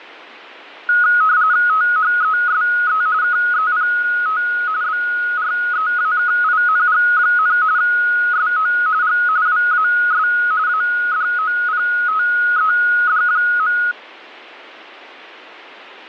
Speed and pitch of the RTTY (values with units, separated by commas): 45.45 baud, 170 Hz shift, 1360 Hz centre